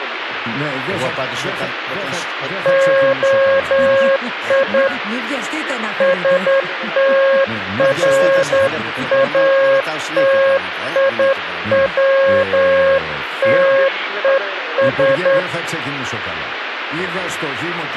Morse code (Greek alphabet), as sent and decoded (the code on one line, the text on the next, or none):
--- .. / ... - .-. .- - .. .-- - . ...
ΟΙ ΣΤΡΑΤΙΩΤΕΣ